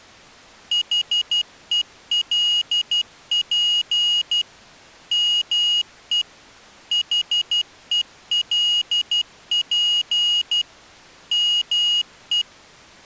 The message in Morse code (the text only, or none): HELP ME HELP ME